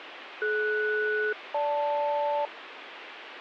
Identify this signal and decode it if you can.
Aircraft SELCAL, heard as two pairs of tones, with radio hiss. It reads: DS-GL